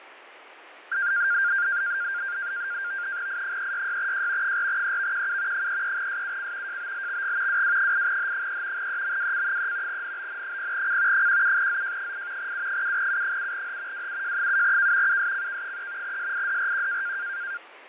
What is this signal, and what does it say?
NAVTEX (SITOR-B), 100 baud, 170 Hz shift, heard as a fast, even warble, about 1500 Hz centre, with radio static and fading. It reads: I366J 4EVQU 33SUC JBLXG WW8H3 EMWC3 NBN0C 17ZJ8 U7U7H WUJ7K USCK3 SIDRQ